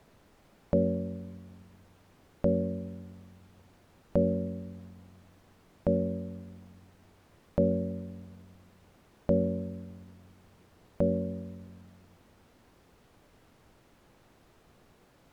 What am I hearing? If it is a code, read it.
Clock strike, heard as a bell. 7. Seven o'clock.